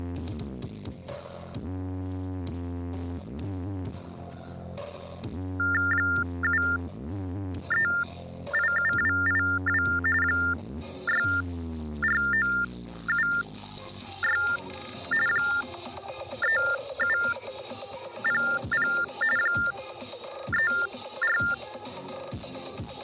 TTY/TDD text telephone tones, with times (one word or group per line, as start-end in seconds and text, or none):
5.9-9.8 7387282
10.2-14.4 64976
15.3-18.9 3700
19.4-21.4 34